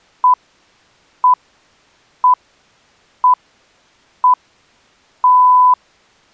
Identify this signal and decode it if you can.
Radio time signal (six pips, as the Greenwich Time Signal), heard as pips.